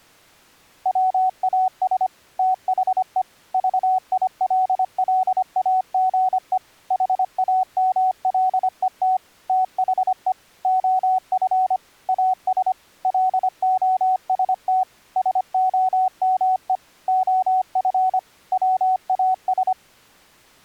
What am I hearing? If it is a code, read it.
Morse code, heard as a keyed tone, machine-sent, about 25 wpm, 750 Hz. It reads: WAS THE VILLAGE HAMLET THE OF AS LOST SOME OF WAS